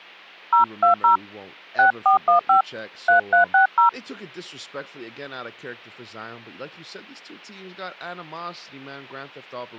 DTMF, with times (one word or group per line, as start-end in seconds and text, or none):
0.5-1.2 020
1.8-2.6 6415
3.1-3.9 3360